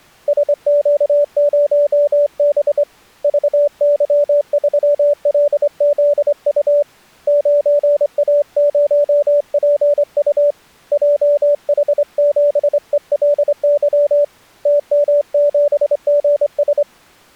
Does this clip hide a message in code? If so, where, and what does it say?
Yes: Morse code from 0.2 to 16.9 s, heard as a keyed tone, hand-sent with a straight key, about 25 wpm, 580 Hz. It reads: SQ0B VY3LZU 9A0PU JH7ELY TM7GS